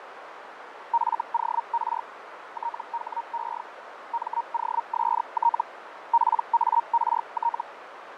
Hellschreiber (Feld-Hell, 122.5 baud), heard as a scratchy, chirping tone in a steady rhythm, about 930 Hz, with radio static, fading and a narrow filter. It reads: FOR THE MOST PART